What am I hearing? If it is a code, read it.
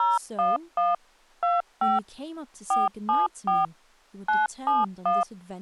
DTMF, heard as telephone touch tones, dialled by machine, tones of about 180 ms, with speech in English. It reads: 011 25 474 971